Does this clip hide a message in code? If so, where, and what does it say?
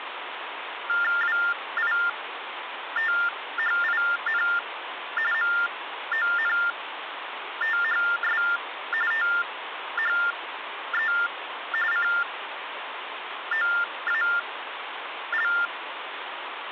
Yes: TTY/TDD text telephone tones (45.45 baud Baudot) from 0.9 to 15.7 s, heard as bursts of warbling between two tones, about 400 Hz shift, 1600 Hz centre, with phone line noise. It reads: WITHIN MONTHS THE COAL